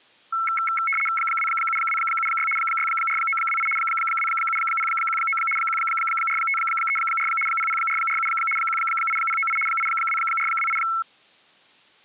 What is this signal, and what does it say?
RTTY (75 baud, 850 Hz shift), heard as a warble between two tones, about 1750 Hz centre. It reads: 27276 64928 27019 14534 00447 18098 82428